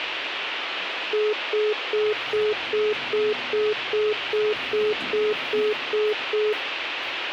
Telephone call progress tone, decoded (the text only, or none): congestion tone